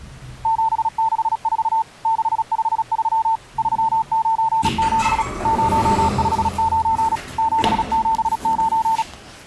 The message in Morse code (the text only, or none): 764 653 397 059 779